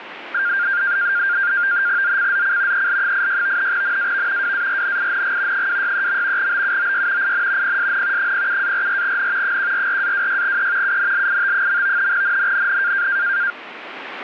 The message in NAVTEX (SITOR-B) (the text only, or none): ZCZC EL86 NAV WARNING 263. BUOY IN PSN 07-44N 144-26E UNLIT. NNNN